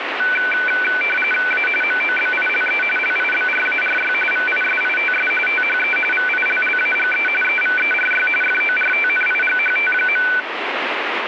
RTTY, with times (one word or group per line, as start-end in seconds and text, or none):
1.5-1.7 A
1.8-2.8 MOBILE
3.0-4.1 LIBRARY
4.3-5.3 VISITS
5.5-6.0 THE
6.1-7.3 VILLAGE
7.4-8.3 EVERY
8.4-10.3 FORTNIGHT.